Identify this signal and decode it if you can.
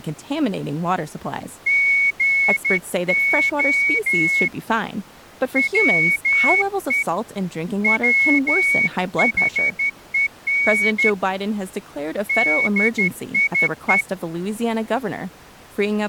Morse code, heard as a whistle, hand-sent with a straight key, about 12 wpm, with speech in English. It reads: GO WE WHEN DIE